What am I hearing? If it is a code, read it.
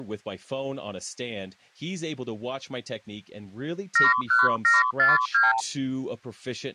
Multi-frequency trunk signalling (R2, with the far end's replies), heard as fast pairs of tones, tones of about 170 ms, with speech in English. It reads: 71742